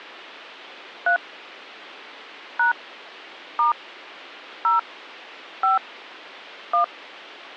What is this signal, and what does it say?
DTMF, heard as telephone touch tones, dialled by hand, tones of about 120 ms. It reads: 3 # * 0 5 1